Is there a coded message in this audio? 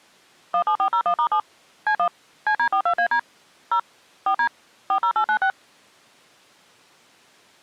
Yes: DTMF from 0.5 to 5.5 s, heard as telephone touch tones, dialled by machine, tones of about 80 ms. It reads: 17401*7 C1 CD42AD 0 4D 40896